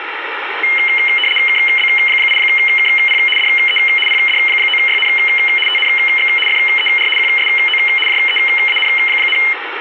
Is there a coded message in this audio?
Yes: RTTY (75 baud, 850 Hz shift) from 0.6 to 9.5 s, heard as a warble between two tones, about 2550 Hz centre, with radio static. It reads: KB8KP DE PD9YN TNX FER QSO JEAN,